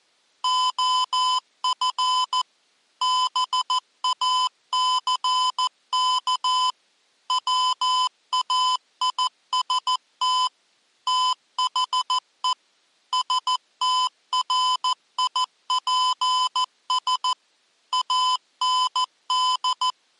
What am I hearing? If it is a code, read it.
Morse code, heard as electronic beeps, machine-sent, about 14 wpm, 1010 Hz. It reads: OF BACK WAIST THE STRIPS AND